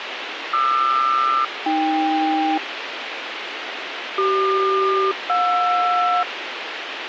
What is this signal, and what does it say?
Aircraft SELCAL, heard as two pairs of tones, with radio hiss. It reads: QR-AK CQ-JR